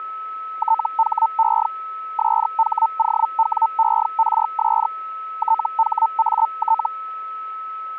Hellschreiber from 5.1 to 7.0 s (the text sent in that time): THAT